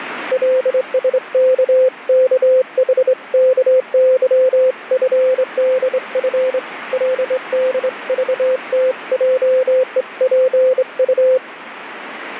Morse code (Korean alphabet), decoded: 경우에는 그러하지

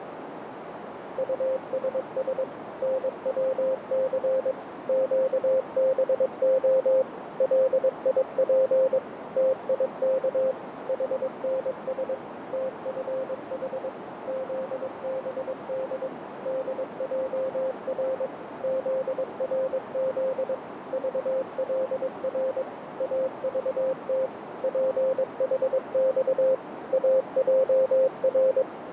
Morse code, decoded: USS NWC QBO LIP TIK HNS TFH ZBD DJR ZRZ VLR AVT PHX AJR

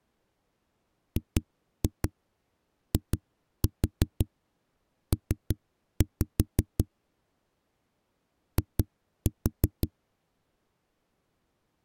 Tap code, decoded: GIP I

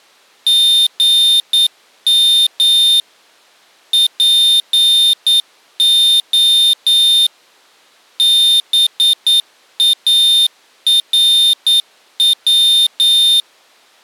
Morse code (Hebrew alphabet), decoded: גם פה בארץ

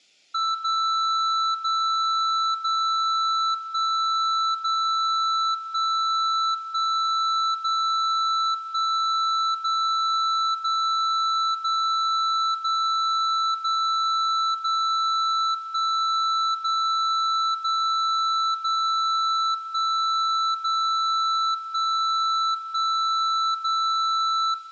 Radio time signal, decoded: 0 0 0 1 0 1 1 0 1 0 0 0 0 0 0 1 0 0 0 1 0 1 1 0

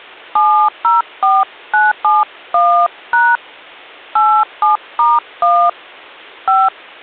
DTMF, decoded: 704971# 87*1 5

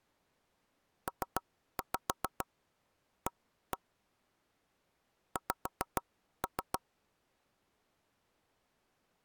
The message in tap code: PA X

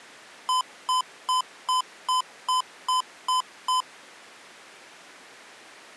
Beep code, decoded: 9 short

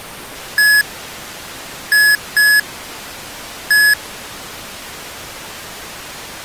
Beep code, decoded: 1-2-1

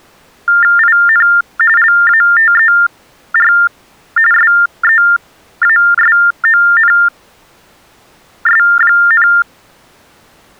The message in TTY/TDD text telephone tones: IN LATER SEASONS,

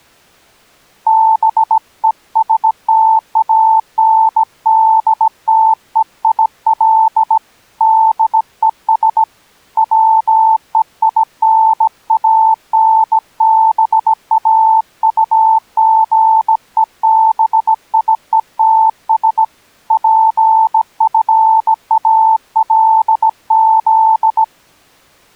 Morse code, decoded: BESTANDTEIL DES WEINANBAUGEBIETS PFALZ

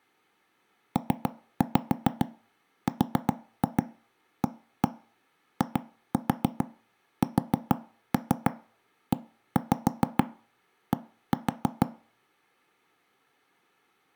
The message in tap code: PRAISED

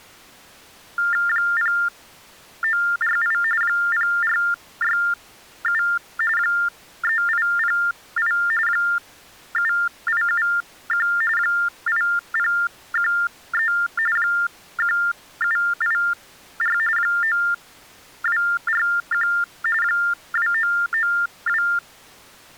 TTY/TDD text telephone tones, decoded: 0948 0467 3808 7871 8013 1784 9241 2992

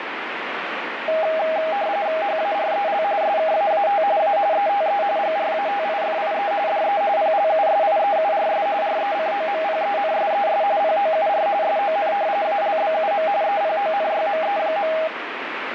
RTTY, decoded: HAREL SKAAT A ETE GRATIFIE DE PLUSIEURS RECOMPENSES POUR SON ALBUM EPONYME.

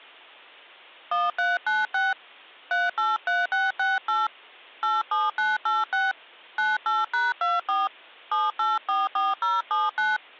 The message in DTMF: 1396 383668 87986 98#24 7844079

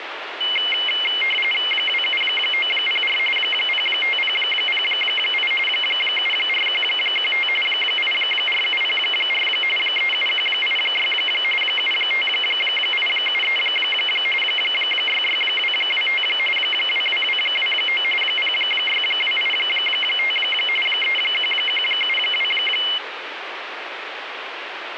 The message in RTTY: 27904 05008 74115 84704 37186 75873 66225 22229 06285 31172

